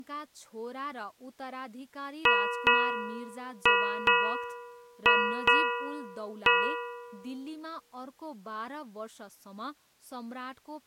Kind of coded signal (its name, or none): ship's bell